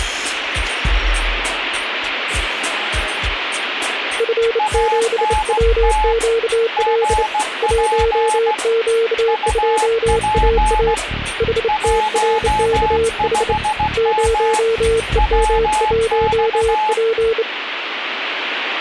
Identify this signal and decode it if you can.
Morse code, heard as two keyed tones, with radio static. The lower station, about 28 wpm, 460 Hz: F7WQL 1Q2AA HTRKH 0EM1P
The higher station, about 16 wpm, 860 Hz: ANT GP UP 15M WX